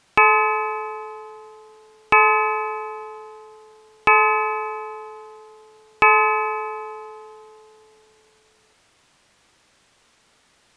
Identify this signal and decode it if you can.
Clock strike, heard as a bell. 4. Four o'clock.